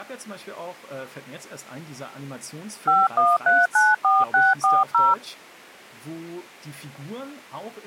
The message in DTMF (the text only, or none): 51394640